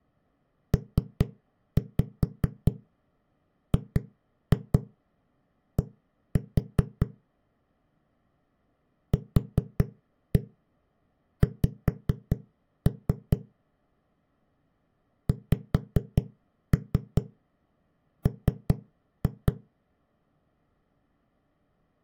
Tap code, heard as knocks on a wall, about 4 knocks a second. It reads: PGD QX XM